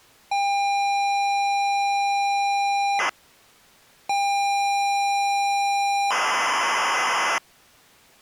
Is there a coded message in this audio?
Yes: ZX Spectrum tape loading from 0.3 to 7.4 s, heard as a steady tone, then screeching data.